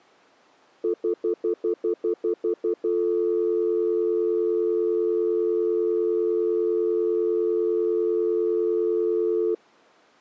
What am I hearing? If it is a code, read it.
Telephone call progress tone (North American plan), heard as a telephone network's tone, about 350, 440 Hz, 0.1 s on and 0.1 s off. Stutter dial tone.